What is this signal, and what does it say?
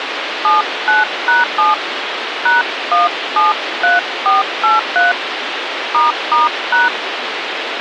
DTMF, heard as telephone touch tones, dialled by hand, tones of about 160 ms, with radio hiss. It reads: 79#7 #173483 **#